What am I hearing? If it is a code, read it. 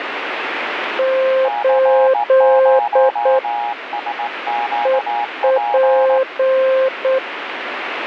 Morse code, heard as two keyed tones, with radio static. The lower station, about 8 wpm, 530 Hz: 8 EP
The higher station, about 18 wpm, 830 Hz: C0SQP